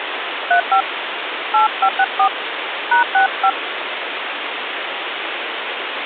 DTMF, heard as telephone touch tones, dialled by hand, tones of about 90 ms, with phone line noise. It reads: 35 8564 #65